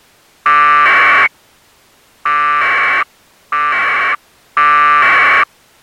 Packet radio (AX.25, as in APRS), 1200 baud, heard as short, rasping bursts.